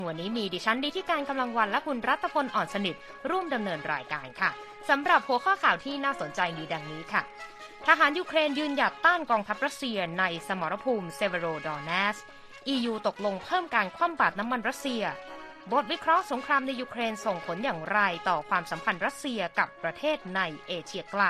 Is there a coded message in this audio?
No.